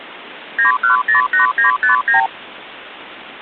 Multi-frequency trunk signalling (R2, with the far end's replies), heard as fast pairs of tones, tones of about 120 ms, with phone line noise. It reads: 9108959